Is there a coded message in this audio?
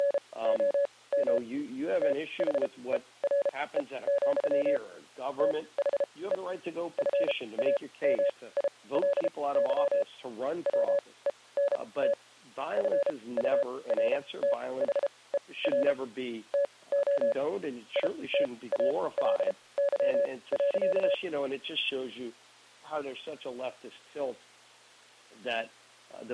Yes: Morse code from 0.0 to 21.2 s, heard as a keyed tone, machine-sent, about 33 wpm, spaced as for 21 wpm, 560 Hz. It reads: … THERE, THE FAMILY WENT FURTHER TO ITALY.